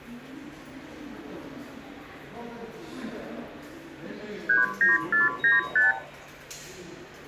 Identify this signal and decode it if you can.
Multi-frequency trunk signalling (R2, with the far end's replies), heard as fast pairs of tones, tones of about 160 ms, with room echo and the noise of a subway station. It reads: 39495